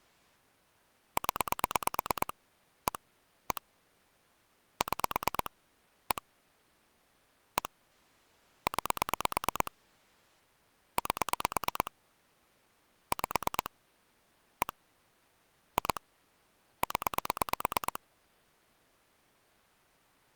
Pulse dialling, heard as clicks on a phone line, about 9 pulses a second. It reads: 0 1 1 6 1 1 9 8 5 1 2 0